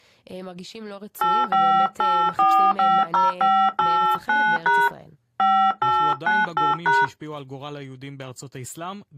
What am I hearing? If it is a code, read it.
DTMF, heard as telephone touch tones, dialled by hand, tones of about 260 ms, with speech in Hebrew. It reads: 858450589# 5898#